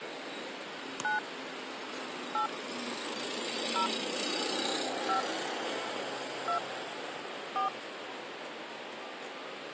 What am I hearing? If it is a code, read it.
DTMF, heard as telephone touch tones, dialled by hand, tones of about 110 ms, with radio hiss and the noise of a residential street. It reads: 9 8 0 5 2 4